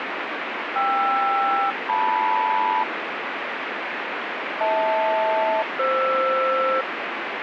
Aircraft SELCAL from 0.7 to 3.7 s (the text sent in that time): KR-LM